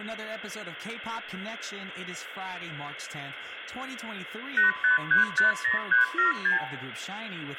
Multi-frequency trunk signalling (R2, with the far end's replies), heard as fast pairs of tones, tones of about 130 ms, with phone line noise and speech in English. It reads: 85350376